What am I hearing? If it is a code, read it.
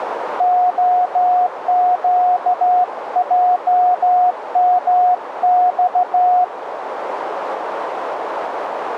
Morse code, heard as a keyed tone, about 14 wpm, 720 Hz, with radio static and a narrow filter. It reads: OQJMX